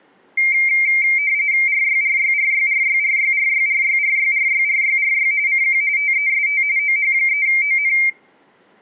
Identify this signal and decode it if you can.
RTTY (45.45 baud, 170 Hz shift), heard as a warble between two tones, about 2200 Hz centre, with room echo. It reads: RYRYRYRYRYRYRYRYRYRYRY CQ TEST OH3ON